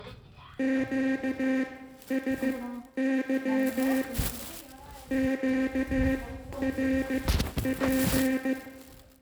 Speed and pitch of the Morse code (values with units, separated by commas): 15 wpm, spaced as for 11 wpm